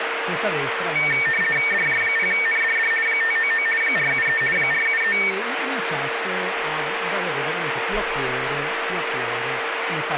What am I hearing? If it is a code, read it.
RTTY (50 baud, 450 Hz shift), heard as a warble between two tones, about 2050 Hz centre, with radio static, a steady whistle near 460 Hz and speech in Italian. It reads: DJ0NDD 599 473 473